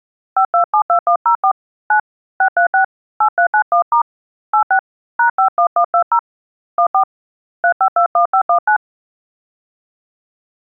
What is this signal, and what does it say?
DTMF, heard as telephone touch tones, dialled by hand, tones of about 90 ms. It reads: 5272104 9 636 8391* 86 #51120 14 3521519